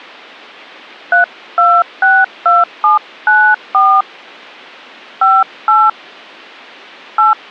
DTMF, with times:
1.1-4.0 3262794
5.2-5.9 58
7.2-7.3 8

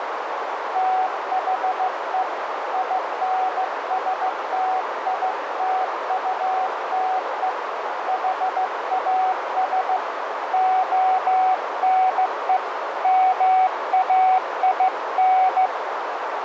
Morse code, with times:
0.8-2.2 THE
2.7-7.5 INSTITUTE
8.1-10.0 HAS
10.5-12.6 ONE
13.0-15.7 MAIN

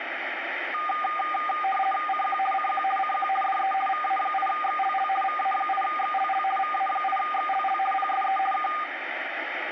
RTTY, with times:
2.1-2.4 CQ
2.5-2.8 CQ
3.0-3.3 CQ
3.4-3.7 DE
3.9-5.1 VA8XLL
5.2-6.4 VA8XLL
6.6-7.8 VA8XLL
7.9-8.4 PSE
8.5-8.7 K

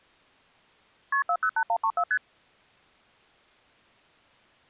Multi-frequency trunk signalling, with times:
1.1-1.2 KP
1.3-2.0 408134
2.1-2.2 ST

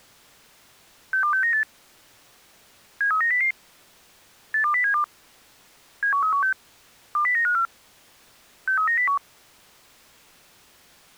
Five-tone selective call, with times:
1.1-1.6 62698
3.0-3.5 73900
4.5-5.0 82072
6.0-6.5 71316
7.2-7.7 20954
8.7-9.2 63901

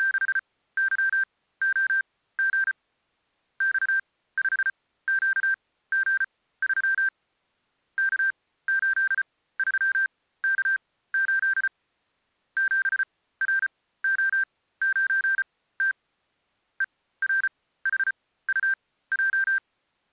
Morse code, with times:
0.0-2.7 …
3.6-7.1 X5QG3
8.0-11.7 K83K8
12.6-15.9 7RO9T
16.8-19.6 ERHUJ

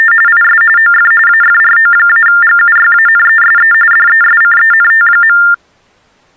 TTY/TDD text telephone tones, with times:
0.0-0.1 …
0.3-0.6 IS
0.8-1.1 OF
1.3-3.7 AFRO-GUYANESE
3.9-5.4 DESCENT.

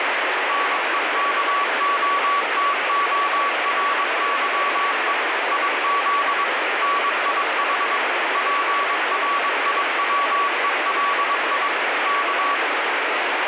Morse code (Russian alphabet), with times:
0.5-5.1 НЕКОТОРЫЕ
5.5-6.4 ИЗ
6.8-8.0 НИХ
8.4-11.7 ПРИВЕЛИ
12.1-12.6 К

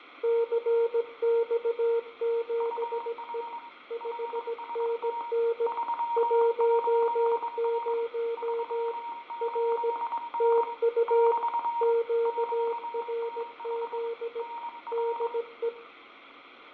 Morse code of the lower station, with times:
0.2-3.4 CX7E
3.9-5.7 5NN
6.2-8.9 10
9.4-9.9 R
10.4-11.3 TU
11.8-14.4 QRZ
14.9-15.7 DE

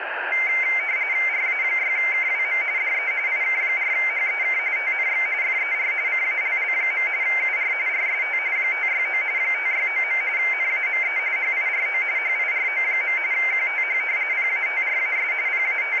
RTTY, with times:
1.3-2.6 RA6KWM
2.8-3.1 DE
3.3-4.6 IK4HEK
4.8-5.3 TNX
5.4-5.9 FER
6.1-7.1 CALL.
7.2-7.7 UR
7.9-8.4 RST
8.6-9.2 569
9.4-10.2 569.
10.4-11.2 NAME
11.4-12.0 HIRO
12.2-13.2 HIRO.
13.3-14.0 QTH
14.3-15.3 PATRAS
15.5-16.0 …

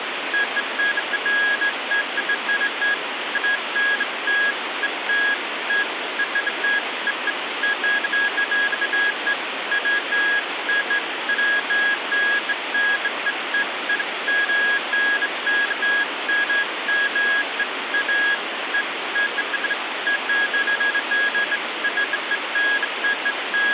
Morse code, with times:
none

